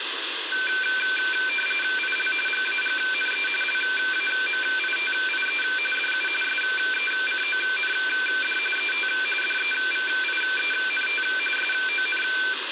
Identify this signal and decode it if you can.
RTTY (45.45 baud, 850 Hz shift), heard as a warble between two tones, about 1950 Hz centre, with radio static. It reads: IL GAGNE LAMITIE DU SECOND ET DEVIENT SON